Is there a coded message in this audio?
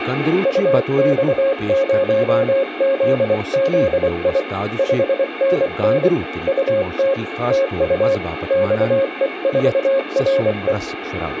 Yes: Morse code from 0.4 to 10.8 s, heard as a keyed tone, hand-sent with a paddle, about 24 wpm, 540 Hz, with radio static and speech in Kashmiri. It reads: UX0ZZI 5NN UT TU XE4RE